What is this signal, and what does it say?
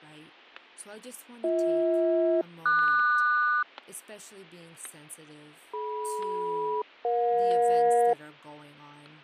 Aircraft SELCAL, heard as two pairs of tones, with fading, static crashes and speech in English. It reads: BH-QS DM-EJ